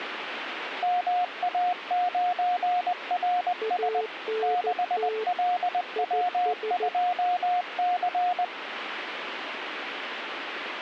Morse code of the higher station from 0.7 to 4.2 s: MA9RS

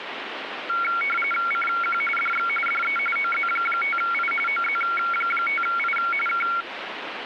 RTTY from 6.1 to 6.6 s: K

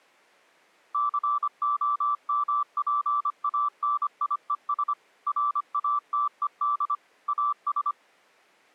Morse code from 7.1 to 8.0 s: AS

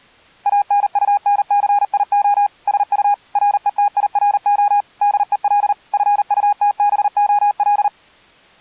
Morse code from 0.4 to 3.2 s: ANUNCIO SU

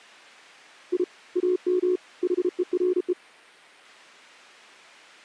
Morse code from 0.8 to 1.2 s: I

